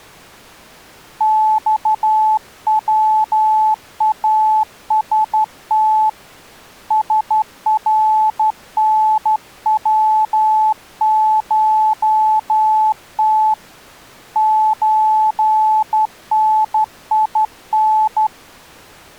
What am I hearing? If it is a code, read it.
Morse code (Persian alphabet), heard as a keyed tone, hand-sent with a straight key, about 12 wpm, 870 Hz. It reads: خواست سرنوشت چنین